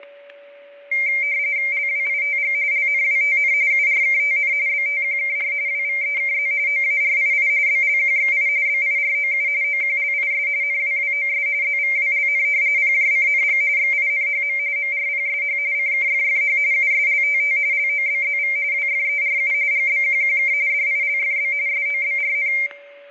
RTTY (45.45 baud, 170 Hz shift), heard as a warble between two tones, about 2200 Hz centre, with static crashes and a steady whistle near 570 Hz. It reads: LWITG LNWTN URKTN BTQKR WVEKZ OARII BLQXI BIROU OQLIS NWWOS ZVWLN PJCNG XINHM MRPSH CKFFH USLTT LOBZV WFERU GBQQK DILFB SOBRN